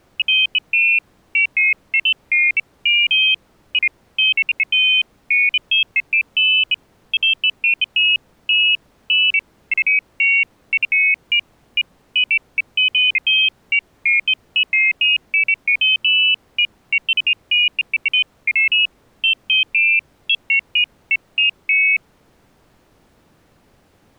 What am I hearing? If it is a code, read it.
Pairs of high tones at irregular times. There is no code.